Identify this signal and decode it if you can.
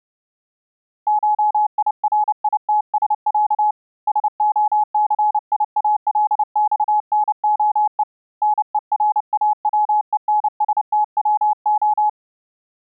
Morse code (Russian alphabet), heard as a keyed tone, hand-sent with a paddle, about 29 wpm, 840 Hz. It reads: ШИРИТСЯ СОЦИАЛЬНОЕ НЕРАВЕНСТВО